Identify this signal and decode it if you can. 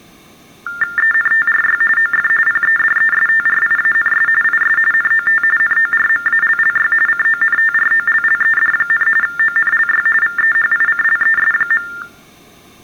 TTY/TDD text telephone tones (45.45 baud Baudot), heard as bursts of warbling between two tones, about 400 Hz shift, 1600 Hz centre. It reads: ENTRY OF PEDESTRIANS IS NOT NORMALLY CONTROLLED, ONLY VEHICLES.